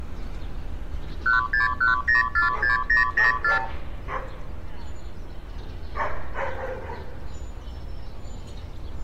Multi-frequency trunk signalling (R2, with the far end's replies), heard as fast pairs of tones, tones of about 140 ms, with street noise. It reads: 161046004